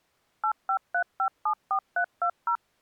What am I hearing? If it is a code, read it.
DTMF, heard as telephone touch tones, dialled by machine, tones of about 80 ms. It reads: 853574320